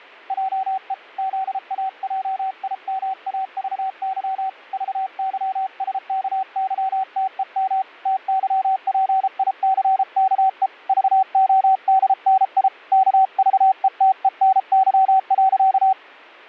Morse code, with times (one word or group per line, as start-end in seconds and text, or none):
0.3-0.9 JE
1.2-4.5 ZAJIMAVY
4.7-7.8 VYSKYTEM
8.1-10.7 TYPICKE
10.9-12.7 VODNI
12.9-15.9 KVETENY.